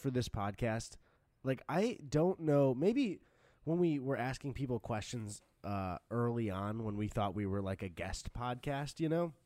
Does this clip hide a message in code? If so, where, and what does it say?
No, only speech in English.